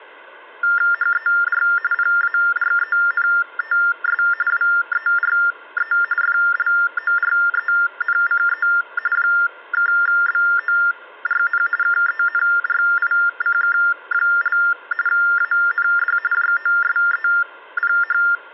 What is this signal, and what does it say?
TTY/TDD text telephone tones (45.45 baud Baudot), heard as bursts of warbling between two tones, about 400 Hz shift, 1600 Hz centre, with hum. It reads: HER PARENTS WERE FLORENCE (BORN KENRICK) AND JOSEPH